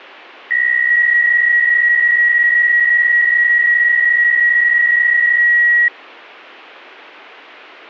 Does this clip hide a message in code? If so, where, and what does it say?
Yes: PSK63 (62.5 baud) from 0.5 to 5.9 s, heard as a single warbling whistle, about 1900 Hz.